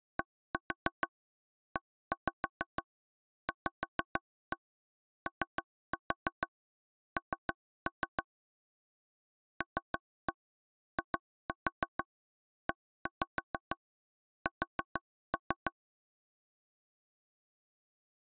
Tap code, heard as taps on a table, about 6 knocks a second. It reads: DEVON LIES